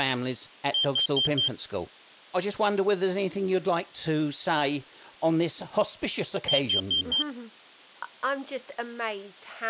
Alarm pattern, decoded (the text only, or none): temporal four